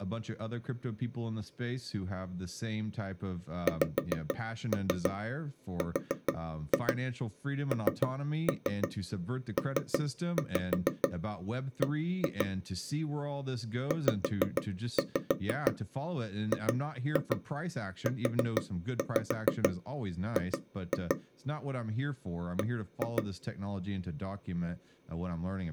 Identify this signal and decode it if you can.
Tap code, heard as taps on a table, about 6 knocks a second, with speech in English. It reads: XRNPB ZGUG B